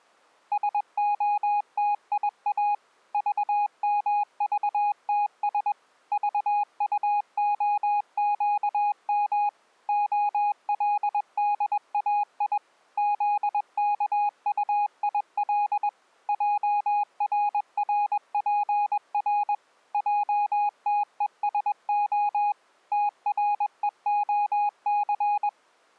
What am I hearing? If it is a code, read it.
Morse code, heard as a keyed tone, machine-sent, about 21 wpm, 830 Hz. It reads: SOTIA VMVTS VUOQM OLDAI ZKUIL JRRPR JTESO TREOC